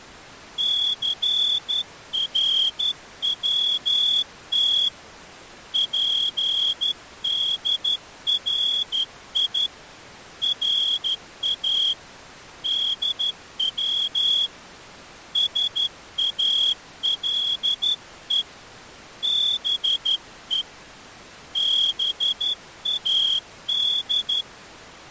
Morse code (Persian alphabet), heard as a whistle, hand-sent with a straight key, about 12 wpm. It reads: ثروت پدری را دو ساله به باد